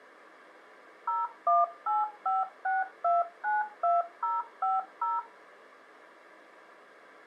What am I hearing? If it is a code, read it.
DTMF, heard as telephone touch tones, dialled by machine, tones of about 180 ms. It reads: 01856292050